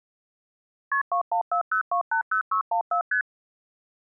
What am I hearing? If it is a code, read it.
Multi-frequency trunk signalling (R1, as on North American trunks), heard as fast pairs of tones, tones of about 100 ms. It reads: KP 2140280614 ST